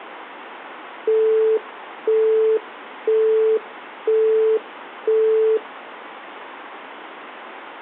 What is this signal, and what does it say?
Telephone call progress tone (single-tone plan, as in Europe, Japan and elsewhere), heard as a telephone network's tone, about 440 Hz, 0.5 s on and 0.5 s off. Busy tone.